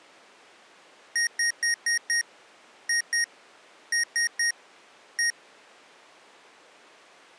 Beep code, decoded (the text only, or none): 5-2-3-1